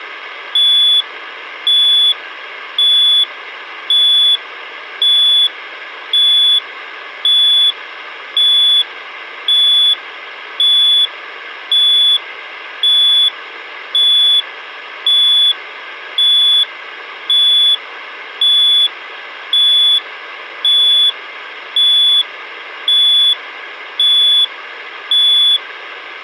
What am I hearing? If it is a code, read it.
Evenly repeated beeps, with hum. There is no code.